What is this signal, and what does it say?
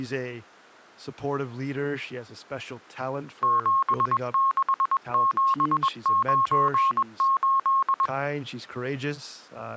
Morse code, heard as a keyed tone, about 21 wpm, 1080 Hz, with speech in English. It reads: 76798